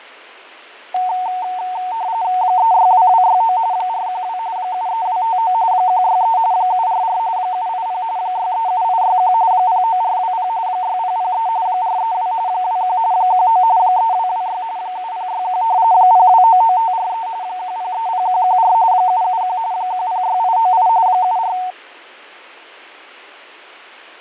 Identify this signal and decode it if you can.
RTTY (45.45 baud, 170 Hz shift), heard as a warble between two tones, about 820 Hz centre, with radio static and fading. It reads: 362269 412 73259 163 744 780 637861 09420 6003 432 21 19 3226 7061 0299543 1030114 771 106898 74